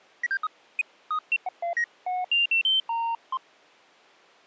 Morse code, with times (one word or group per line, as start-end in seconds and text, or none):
none